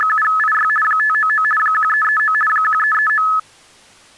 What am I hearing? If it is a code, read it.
RTTY (50 baud, 450 Hz shift), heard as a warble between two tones, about 1500 Hz centre. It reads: … 599 1339 1339